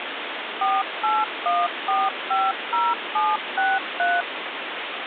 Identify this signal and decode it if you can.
DTMF, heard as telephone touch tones, dialled by machine, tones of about 210 ms, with phone line noise. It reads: 481450763